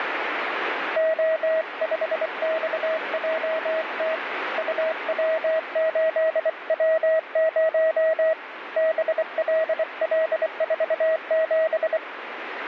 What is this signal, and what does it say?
Morse code, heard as a keyed tone, hand-sent with a bug key, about 24 wpm, 640 Hz, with radio static. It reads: O5XJT UW8W0 BLL47